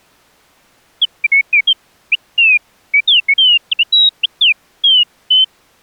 Bird-like chirps. There is no code.